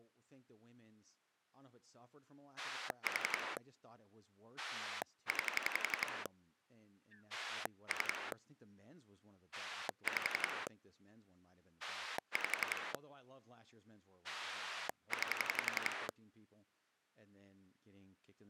Pulse dialling, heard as a rotary dial, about 11 pulses a second, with speech in English. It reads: 4 9 3 5 5 9